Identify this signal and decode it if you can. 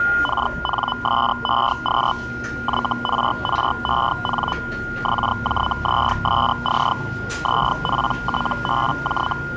Hellschreiber (Feld-Hell, 122.5 baud), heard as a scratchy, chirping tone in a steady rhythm, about 1000 Hz, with a steady whistle near 1420 Hz and the noise of a cafe. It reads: KNSEQ YRREN XJZSC ZPTBJ